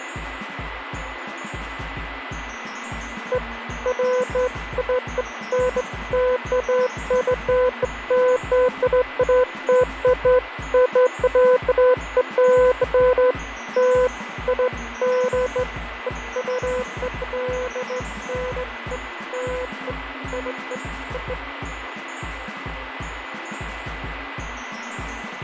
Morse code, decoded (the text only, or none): none